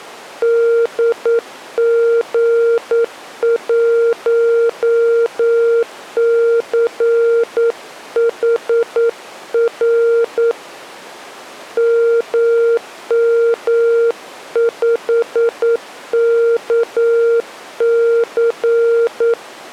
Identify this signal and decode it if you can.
Morse code, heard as a keyed tone, hand-sent with a paddle, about 9 wpm, 460 Hz. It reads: DG1CHR MM5KC